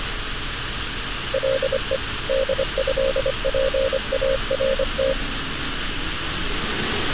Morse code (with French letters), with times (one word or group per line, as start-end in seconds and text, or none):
1.3-2.0 LE
2.3-5.1 DÉPART